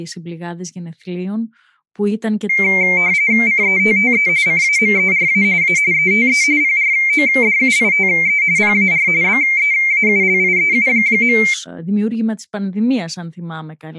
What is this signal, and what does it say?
RTTY (45.45 baud, 170 Hz shift), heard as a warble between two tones, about 2200 Hz centre, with speech in Greek. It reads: CETTE CAMERA A ETE PRODUITE PAR BEAULIEU.